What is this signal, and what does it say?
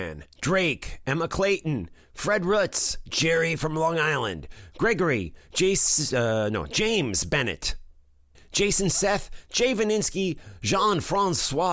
Speech in English. There is no code.